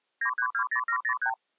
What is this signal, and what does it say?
Multi-frequency trunk signalling (R2, with the far end's replies), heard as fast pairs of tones, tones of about 80 ms. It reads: 9320703